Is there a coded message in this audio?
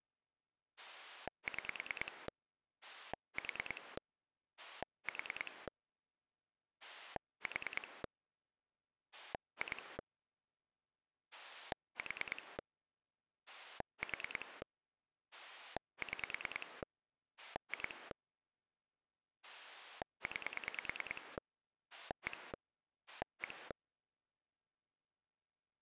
Yes: pulse dialling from 0.8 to 23.7 s, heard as a rotary dial, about 9 pulses a second. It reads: 6 4 4 4 2 4 4 6 2 9 1 1